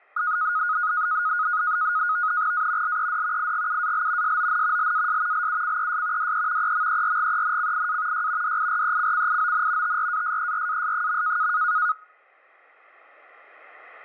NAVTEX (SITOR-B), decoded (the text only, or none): A LED IGUAL SON LAS LUCES DE EMERGENCIA Y DIRECCION TRASERAS.